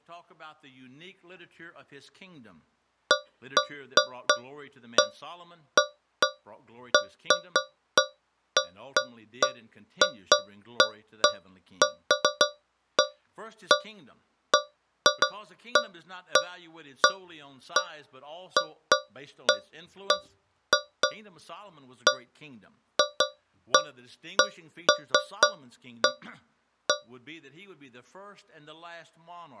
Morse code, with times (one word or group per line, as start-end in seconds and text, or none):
none